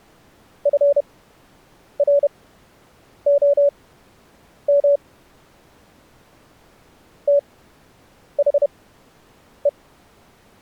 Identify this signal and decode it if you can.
Morse code, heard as a keyed tone, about 31 wpm, spaced as for 8 wpm, 570 Hz. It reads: FROM THE